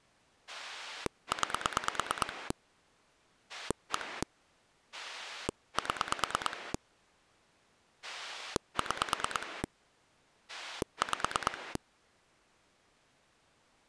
Pulse dialling, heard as a rotary dial, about 9 pulses a second. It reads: 9 1 7 6 5